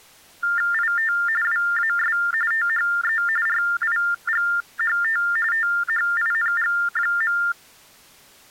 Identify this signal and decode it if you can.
TTY/TDD text telephone tones (45.45 baud Baudot), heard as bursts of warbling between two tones, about 400 Hz shift, 1600 Hz centre. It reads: IT WAS THE RIGHT THING.